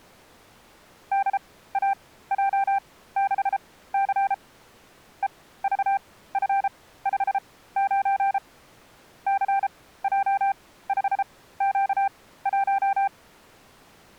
Morse code, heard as a keyed tone, machine-sent, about 33 wpm, spaced as for 17 wpm, 790 Hz. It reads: DAJ6C EVF59 CJ5Q1